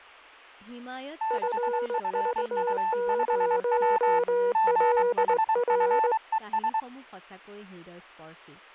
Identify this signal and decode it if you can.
Morse code, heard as two keyed tones, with speech in Assamese. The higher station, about 23 wpm, 880 Hz: 6FU5W GHFES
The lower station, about 19 wpm, 480 Hz: FV0LR